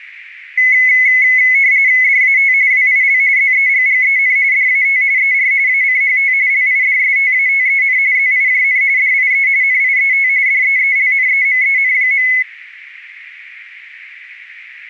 RTTY (45.45 baud, 170 Hz shift), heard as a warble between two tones, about 2100 Hz centre, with radio static. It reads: DAT WIL ZEGGEN DAT ER ACHT LIDSTATEN ZIJN DIE NIET DEELNEMEN.